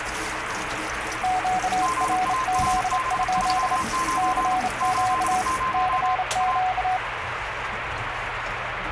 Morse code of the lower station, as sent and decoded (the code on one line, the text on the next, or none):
--.- .-. --.. ..--.. / -.-. --.- / -.-. --.-
QRZ? CQ CQ